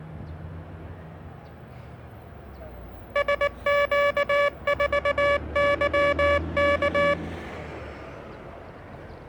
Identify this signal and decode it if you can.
Morse code, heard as a buzzer, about 19 wpm, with street noise. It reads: SQ4YK